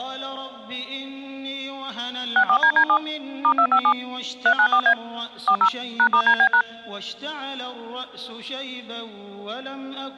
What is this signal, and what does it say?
DTMF, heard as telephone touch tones, dialled by machine, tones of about 80 ms. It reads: 64DD7 *257 394A 40 #*DB#